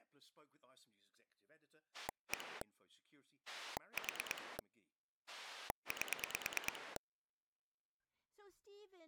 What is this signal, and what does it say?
Pulse dialling, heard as a rotary dial, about 9 pulses a second, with speech in English. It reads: 1 4 8